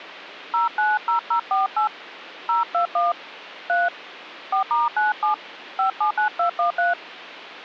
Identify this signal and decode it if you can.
DTMF, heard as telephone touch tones, dialled by hand, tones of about 150 ms. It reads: 090048 021 3 4*97 579213